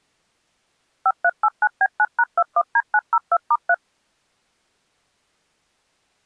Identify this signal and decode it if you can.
DTMF, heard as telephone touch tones, dialled by machine, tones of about 50 ms. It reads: 5389B9#21D902*3